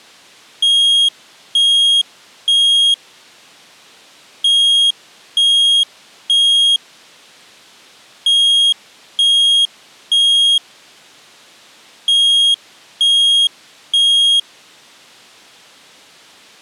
Alarm pattern, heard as an alarm's beeps, played four times, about 3250 Hz. Temporal three. Smoke or fire, evacuate.